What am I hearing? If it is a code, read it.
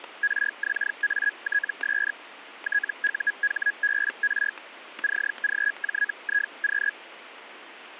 Hellschreiber (Feld-Hell, 122.5 baud), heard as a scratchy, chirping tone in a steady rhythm, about 1650 Hz, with static crashes. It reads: RXATS TUHBR CGJIQ